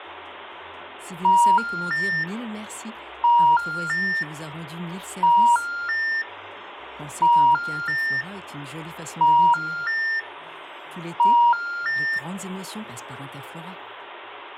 Telephone call progress tone (ITU plan), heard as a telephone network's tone, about 950, 1400, 1800 Hz. Special information tone.